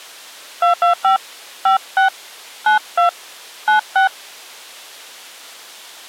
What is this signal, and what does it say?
DTMF, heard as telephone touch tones, dialled by hand, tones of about 120 ms. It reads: 225 56 92 96